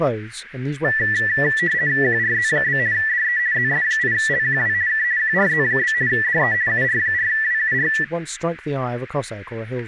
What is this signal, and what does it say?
RTTY (50 baud, 170 Hz shift), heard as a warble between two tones, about 1850 Hz centre, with radio static, static crashes and speech in English. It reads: QRZ? DE ZS8LQW K QRZ? DE UR4WUR